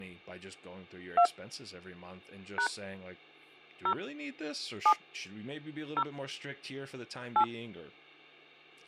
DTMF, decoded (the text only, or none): 2 # 0 7 0 8